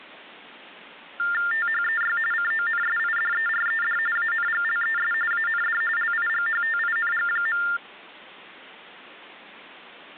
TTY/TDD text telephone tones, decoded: THEY CONSIDERED ANGLES AND LIGHTING.

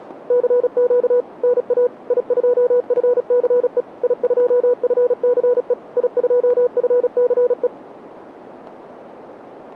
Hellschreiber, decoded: none

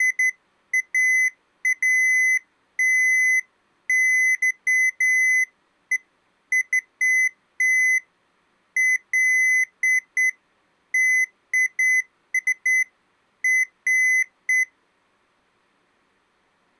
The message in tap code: none

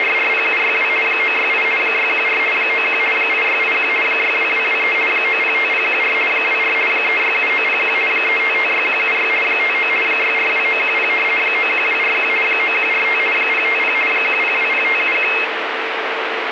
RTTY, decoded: … 968 614 91 8681 62223 905014 24 367901 3556176 59 642910 91241 9145 050 1020571

